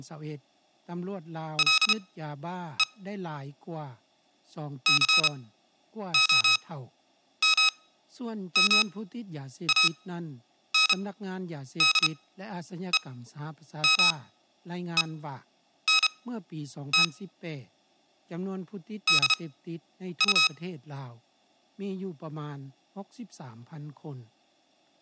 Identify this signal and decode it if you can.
Morse code, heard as electronic beeps, machine-sent, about 32 wpm, spaced as for 9 wpm, 1280 Hz. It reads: LE COMMANDEMENT DU